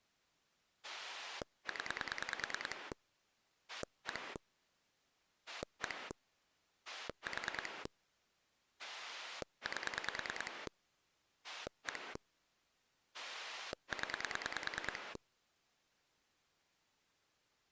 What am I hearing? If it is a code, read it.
Pulse dialling, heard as a rotary dial, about 9 pulses a second. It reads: 0 1 1 4 8 1 0